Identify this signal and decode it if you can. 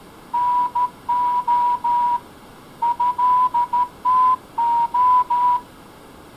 Morse code (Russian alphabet), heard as a whistle, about 13 wpm. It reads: НО ЭТО